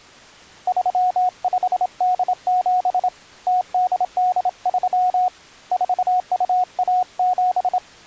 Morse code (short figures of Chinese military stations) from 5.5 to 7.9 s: 4217

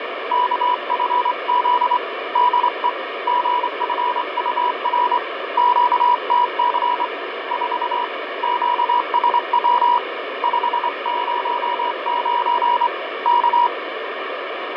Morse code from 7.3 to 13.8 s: 4 QSW 509 K

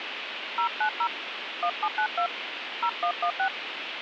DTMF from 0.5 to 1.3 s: 090

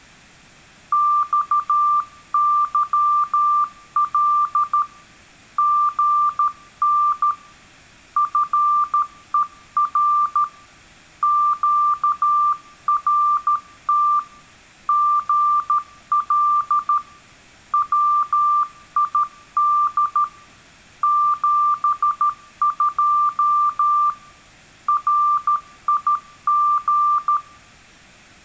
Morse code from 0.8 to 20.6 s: XYL GN FER QRT GL WID

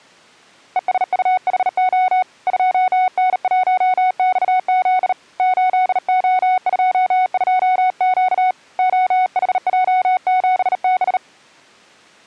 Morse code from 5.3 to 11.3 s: 8O22Q OHJ7B

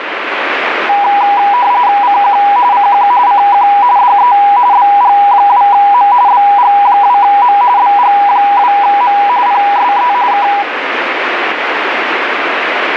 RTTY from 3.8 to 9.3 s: DE BG2M BG2M BG2M

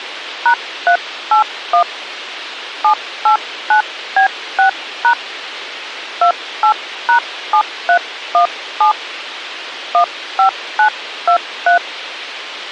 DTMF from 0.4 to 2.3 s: #381

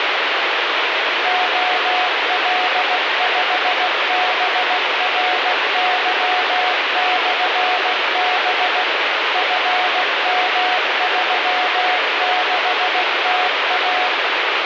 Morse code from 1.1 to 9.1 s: OL5BRY/B

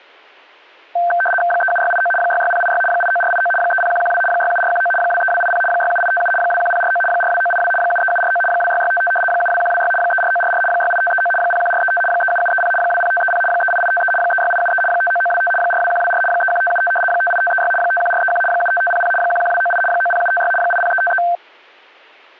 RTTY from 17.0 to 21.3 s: 58536 51431 75500 11298 90756 80353

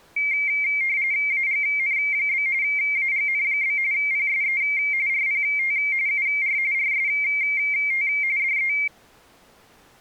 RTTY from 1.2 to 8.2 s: AGN? AGN? PSE RPT UR RST

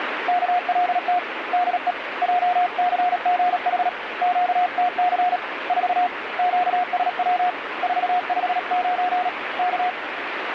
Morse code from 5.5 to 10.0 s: 4 QSW 459 K

